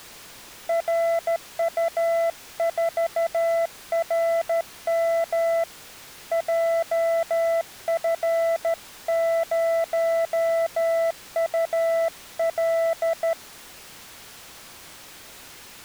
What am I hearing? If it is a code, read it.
Morse code, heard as a keyed tone, hand-sent with a straight key, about 13 wpm, 670 Hz. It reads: RU4RM JF0UL